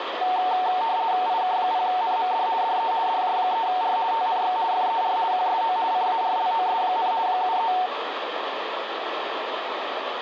RTTY (50 baud, 170 Hz shift), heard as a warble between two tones, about 820 Hz centre, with radio static. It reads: IK0NMD DE DJ3R TNX FER QSO CARLOS, 73